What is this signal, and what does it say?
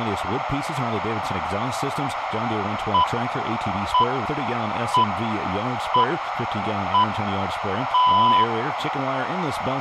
Radio time signal (six pips, as the Greenwich Time Signal), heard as pips, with radio static, a narrow filter and room echo.